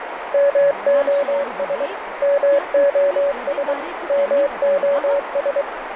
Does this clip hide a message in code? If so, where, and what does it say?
Yes: Morse code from 0.3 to 5.7 s, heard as a keyed tone, machine-sent, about 23 wpm, 560 Hz, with radio static, a narrow filter and speech in Dogri. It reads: MOS MOS MOS